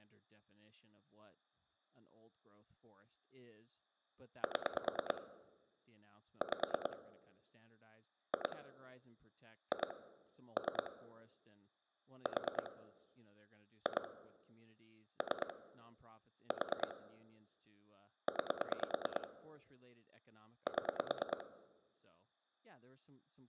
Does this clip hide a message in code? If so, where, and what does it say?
Yes: pulse dialling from 4.4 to 21.4 s, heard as clicks on a phone line, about 9 pulses a second, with room echo and speech in English. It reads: 7 5 2 2 3 4 2 3 4 9 7